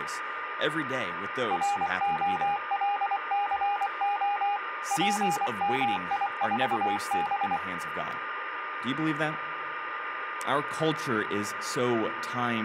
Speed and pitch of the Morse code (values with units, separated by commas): 24 wpm, 820 Hz